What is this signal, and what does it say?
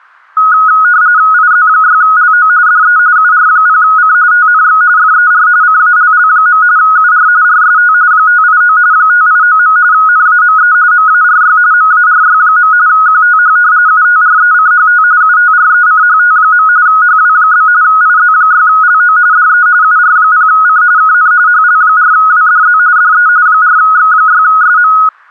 RTTY (45.45 baud, 170 Hz shift), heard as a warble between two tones, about 1360 Hz centre. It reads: IZ6LO DE UR0C TNX FER CALL. UR RST 589 589. NAME MARY MARY. QTH UTRECHT UTRECHT. HW? IZ6LO DE UR0C KN HL4WDZ DE 4X6SM